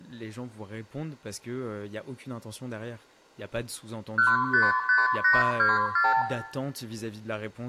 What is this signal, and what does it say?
Multi-frequency trunk signalling (R2, with the far end's replies), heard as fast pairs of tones, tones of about 180 ms, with room echo and speech in French. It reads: 155824